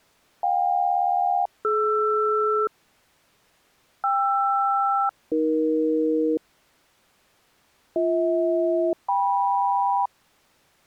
Aircraft SELCAL, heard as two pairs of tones. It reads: JK-DR KR-AE BH-KM